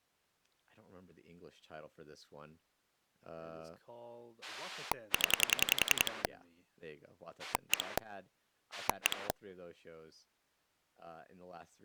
Pulse dialling, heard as a rotary dial, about 10 pulses a second, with speech in English. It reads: 0 1 1